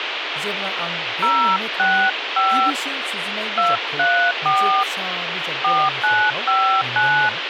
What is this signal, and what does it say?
DTMF, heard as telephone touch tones, dialled by hand, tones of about 280 ms, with radio hiss and speech in Bodo. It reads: 065 234 4959